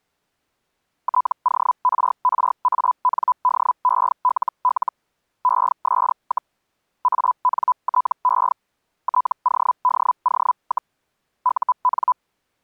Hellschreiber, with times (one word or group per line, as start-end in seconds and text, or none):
1.0-4.9 TORRANDELL
5.4-6.5 ES,
7.0-8.5 ANTE
9.0-10.9 TODO,
11.4-12.1 UN